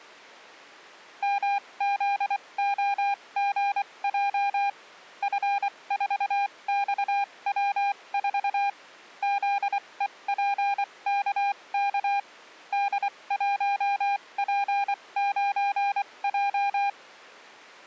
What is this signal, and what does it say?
Morse code, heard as a keyed tone, machine-sent, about 24 wpm, spaced as for 20 wpm, 800 Hz. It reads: MZOGJ F4XW4 ZEPKK D1P9J